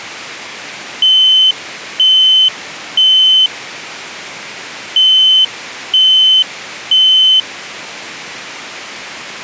Alarm pattern, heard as an alarm's beeps, played twice, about 3050 Hz. Temporal three. Smoke or fire, evacuate.